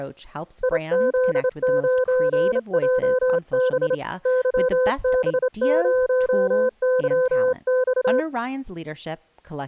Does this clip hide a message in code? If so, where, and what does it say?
Yes: Morse code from 0.6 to 8.3 s, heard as a keyed tone, hand-sent with a straight key, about 28 wpm, 510 Hz, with speech in English. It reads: IZ9JB YB0YX